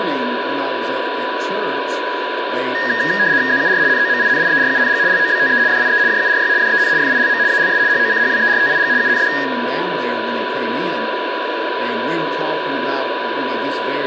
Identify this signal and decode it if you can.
RTTY (75 baud, 170 Hz shift), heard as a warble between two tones, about 1750 Hz centre, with radio static, a steady whistle near 990 Hz and room echo. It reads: ZUR NOMINIERUNG LOBTE DIE JURY DEN FILM ALS HOCHWERTIG UND